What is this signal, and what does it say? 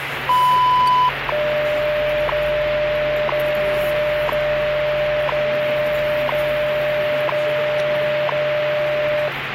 Radio time signal (WWV, Colorado), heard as ticks, one a second, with radio static and the noise of a restaurant.